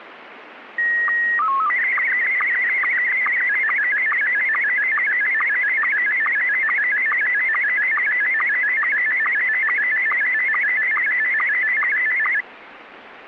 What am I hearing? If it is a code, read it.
SSTV (slow-scan television), Scottie S1, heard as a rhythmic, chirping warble, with radio static.